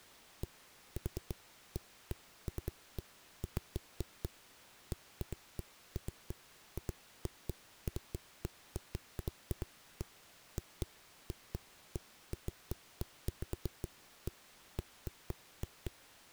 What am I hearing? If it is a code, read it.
Irregular knocks on a wall. There is no code.